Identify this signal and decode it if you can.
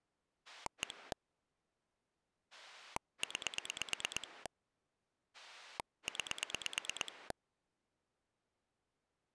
Pulse dialling, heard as a rotary dial, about 9 pulses a second. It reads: 1 9 9